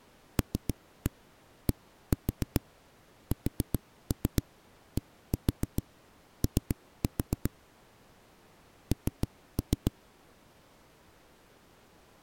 Tap code, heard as knocks on a wall, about 7 knocks a second. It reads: LDSDO N